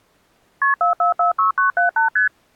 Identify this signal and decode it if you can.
Multi-frequency trunk signalling (R1, as on North American trunks), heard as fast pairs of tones, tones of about 120 ms. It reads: KP 4446978 ST